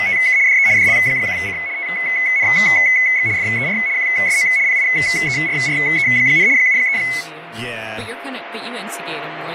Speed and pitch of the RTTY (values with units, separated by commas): 75 baud, 170 Hz shift, 2100 Hz centre